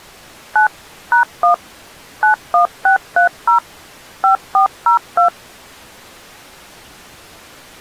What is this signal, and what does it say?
DTMF, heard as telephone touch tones, dialled by machine, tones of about 110 ms. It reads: 9 #1 91630 5402